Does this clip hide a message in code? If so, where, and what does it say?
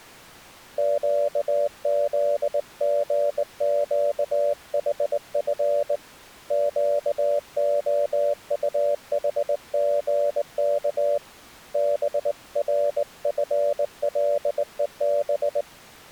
Yes: Morse code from 0.7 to 15.7 s, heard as a keyed tone, hand-sent with a straight key, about 19 wpm, 580 Hz. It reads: QZGQHF QOUHGK BRFLEB